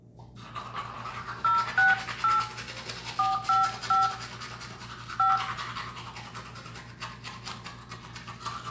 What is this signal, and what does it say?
DTMF, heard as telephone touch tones, dialled by hand, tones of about 160 ms, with room echo and the noise of a restroom. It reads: 068 455 5